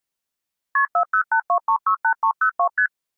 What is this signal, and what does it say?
Multi-frequency trunk signalling (R1, as on North American trunks), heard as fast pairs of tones, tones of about 80 ms. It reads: KP 4082368302 ST